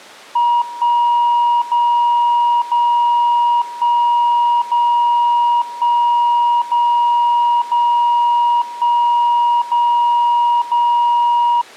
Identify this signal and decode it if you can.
Radio time signal (DCF77), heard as a tone whose level steps once a second, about 950 Hz. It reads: 1 0 0 1 0 1 0 0 1 0 0